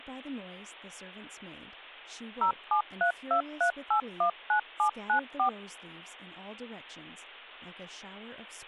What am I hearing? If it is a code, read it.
DTMF, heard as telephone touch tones, dialled by machine, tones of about 100 ms, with hum and speech in English. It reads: 07323819794